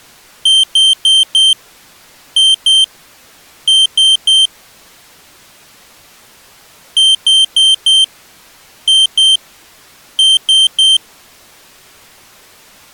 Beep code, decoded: 4-2-3

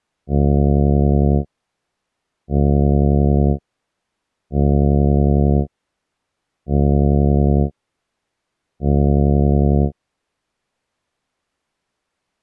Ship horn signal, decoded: 5 short

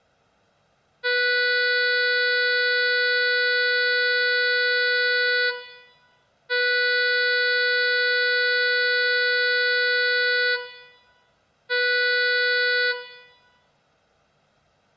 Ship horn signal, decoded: 2 long, 1 short

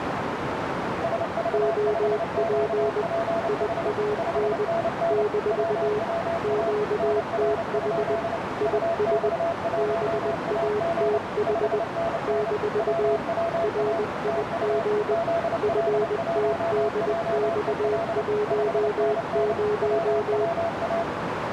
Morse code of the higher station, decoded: SV5QPH 5NN WWA NR? UX1AG 5NN WWA TU ZL1JEL 5NN WWA

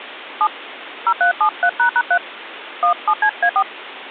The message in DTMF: 7 0373##3 17CA4

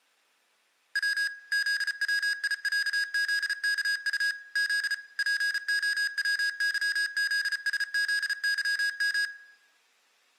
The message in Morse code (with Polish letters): W ZWIĄZKU Z POWYZSZYM

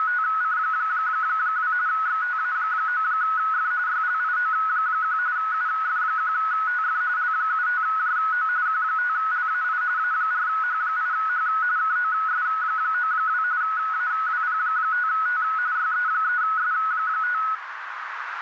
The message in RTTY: … XTA9F YLIO1 UF1TF L75JO Q5LAI A4H8H KOS92 AWP5T YE3S5

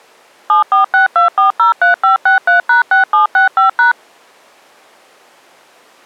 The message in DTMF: 7462403563#6765#

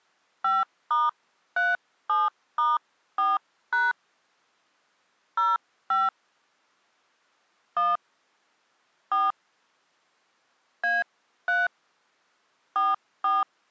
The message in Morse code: none

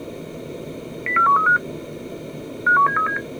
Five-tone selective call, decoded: 04135 51737

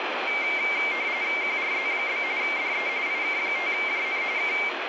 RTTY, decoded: QRZ? DE IK5JN K

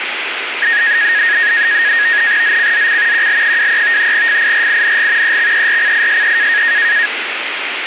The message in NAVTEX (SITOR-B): ZCZC QL23 FIRING EXERCISE

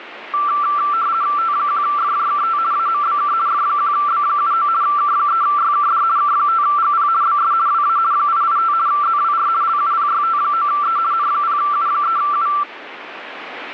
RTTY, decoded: T1FJKT AMBK F1B79 K3YKD K5GP BS WA 885 ZWR LUPYT9E N0U3U

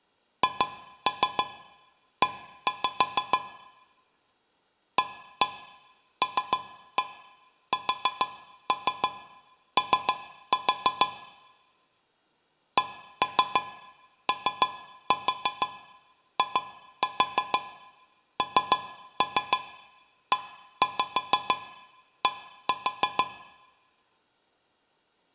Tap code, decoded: HE ALSO COINED

